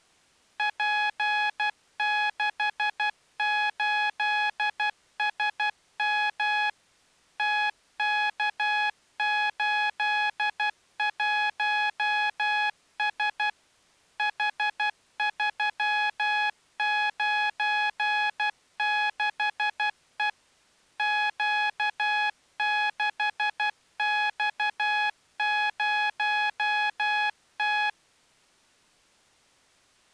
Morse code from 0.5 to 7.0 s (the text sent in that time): P68SM